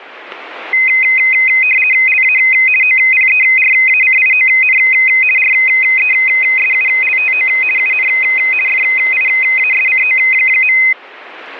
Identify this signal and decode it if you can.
RTTY (50 baud, 450 Hz shift), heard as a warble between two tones, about 2300 Hz centre. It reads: LA OPERACION RESULTO UN FIASCO.